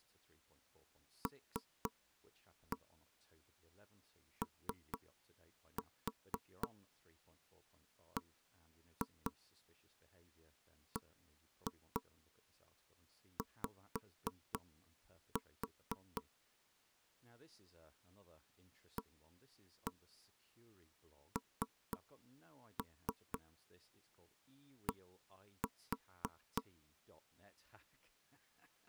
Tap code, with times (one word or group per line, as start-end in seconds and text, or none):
1.3-16.2 LOBBY
19.0-26.6 AND